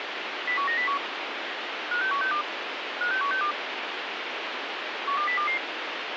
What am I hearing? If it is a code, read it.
Five-tone selective call (CCIR), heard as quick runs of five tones, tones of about 100 ms, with radio hiss. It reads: 01901 56162 56162 12022